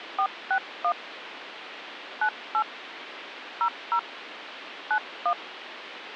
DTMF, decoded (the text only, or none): 461 98 00 91